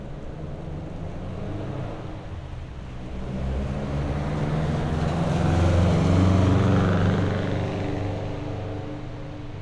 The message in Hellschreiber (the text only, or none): none